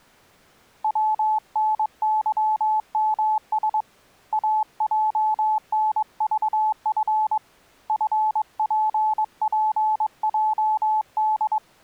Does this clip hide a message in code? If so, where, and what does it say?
Yes: Morse code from 0.8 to 11.6 s, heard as a keyed tone, hand-sent with a paddle, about 22 wpm, 860 Hz. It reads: WNYMS AJNVF FPPJD